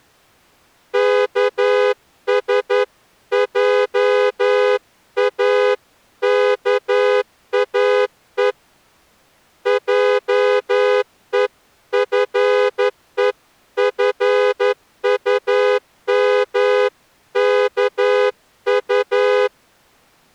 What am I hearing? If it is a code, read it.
Morse code (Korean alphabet), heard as a horn, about 11 wpm. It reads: 여호와 하나님이